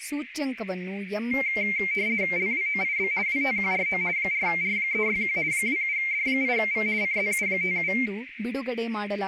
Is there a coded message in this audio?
Yes: RTTY (50 baud, 170 Hz shift) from 1.3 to 8.1 s, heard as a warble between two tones, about 2200 Hz centre, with radio static, a narrow filter and speech in Kannada. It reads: LWOIB WTQRO 4R361 27D8V CZU57